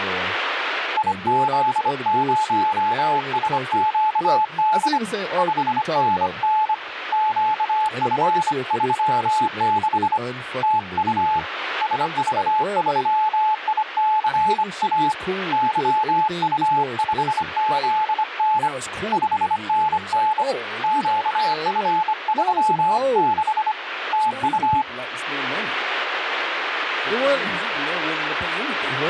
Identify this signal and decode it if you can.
Morse code, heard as a keyed tone, hand-sent with a bug key, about 25 wpm, 860 Hz, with radio static and speech in English. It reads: IZ0SQD 5NN QF36 TU SV3ICA YU5ZN 5NN QF36 TU